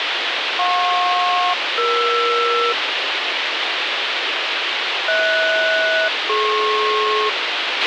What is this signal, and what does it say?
Aircraft SELCAL, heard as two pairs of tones, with radio hiss and a squelch burst at the end. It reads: JP-ER HS-DP